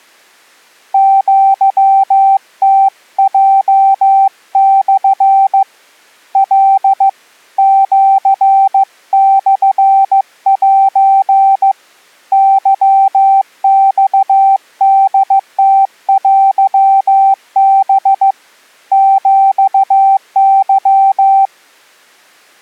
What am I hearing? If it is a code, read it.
Morse code (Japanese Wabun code), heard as a keyed tone, hand-sent with a paddle, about 15 wpm, 780 Hz. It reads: アムヲモ カ シモセ ケマホムテハ ヒケ